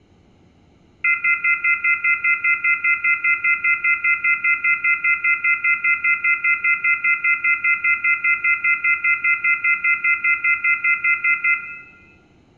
Telephone call progress tone (North American plan), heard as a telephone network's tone, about 1400, 2050, 2450, 2600 Hz, 0.1 s on and 0.1 s off, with room echo. Off-hook warning tone.